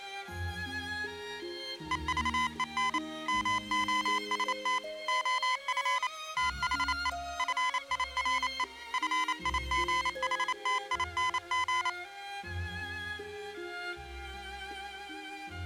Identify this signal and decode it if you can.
Morse code, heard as electronic beeps, machine-sent, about 28 wpm, 1010 Hz. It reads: EVEN MOST OF THE FIRE FIGHTING